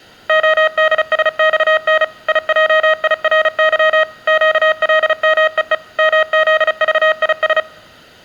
Morse code, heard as electronic beeps, machine-sent, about 35 wpm, 630 Hz. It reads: ODSXN IJIRY QLMEE MZVIS